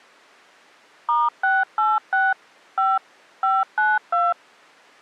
DTMF, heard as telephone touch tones, dialled by machine, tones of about 200 ms. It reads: *686 5 592